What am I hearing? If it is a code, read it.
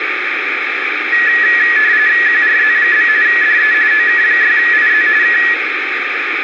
RTTY (45.45 baud, 170 Hz shift), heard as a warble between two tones, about 1800 Hz centre, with radio static. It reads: QRZ? DE OK6IZ K